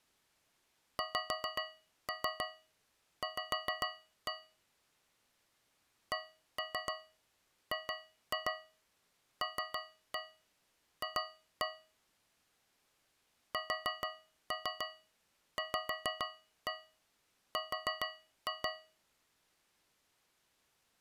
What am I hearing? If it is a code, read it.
Tap code, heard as taps on a metal pipe, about 7 knocks a second. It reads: XV CGLF SVR